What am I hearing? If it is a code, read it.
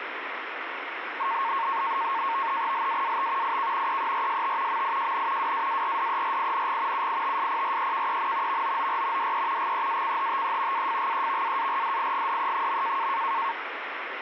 NAVTEX (SITOR-B), 100 baud, 170 Hz shift, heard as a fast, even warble, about 1000 Hz centre, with radio static. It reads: LAAT IK EERST MIJN WAARDERING UITSPREKEN VOOR DE GEACHTE AFGEVAARDIGDE.